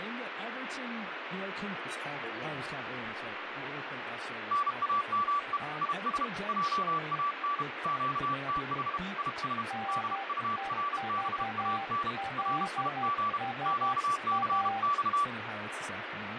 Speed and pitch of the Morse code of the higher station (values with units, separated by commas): 32 wpm, 1160 Hz